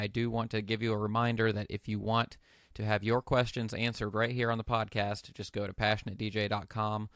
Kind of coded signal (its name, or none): none